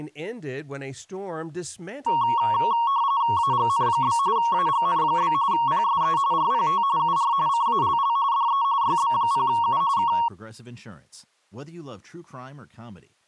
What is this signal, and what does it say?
RTTY (45.45 baud, 170 Hz shift), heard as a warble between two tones, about 1020 Hz centre, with speech in English. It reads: AGN? AGN? PSE RPT UR CALL DE YB0U K